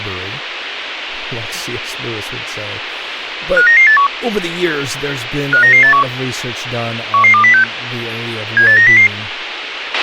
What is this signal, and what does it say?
Five-tone selective call (CCIR), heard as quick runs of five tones, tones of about 100 ms, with radio hiss, a squelch burst at the end and speech in English. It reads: 59981 59981 11206 78900